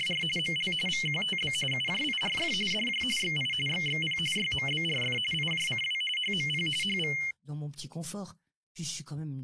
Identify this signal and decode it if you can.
RTTY (45.45 baud, 850 Hz shift), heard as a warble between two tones, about 2550 Hz centre, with speech in French. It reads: … ML VQTB UJIRF DJ XI XXP YMBRF IJCW HMP HV